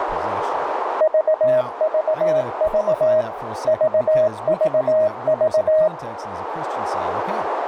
Morse code, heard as a keyed tone, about 18 wpm, 630 Hz, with radio static, a narrow filter and speech in English. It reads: VVV VVV